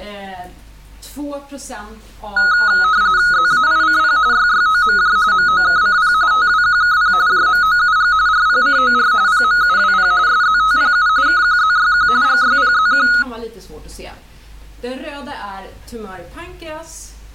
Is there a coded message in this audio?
Yes: RTTY (45.45 baud, 170 Hz shift) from 2.4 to 13.2 s, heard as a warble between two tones, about 1360 Hz centre. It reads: ZAICP YYOMJ MOKCP TWQKP JMOUG RPCOR PMUWP SZTPU KQZYQ GYPZQ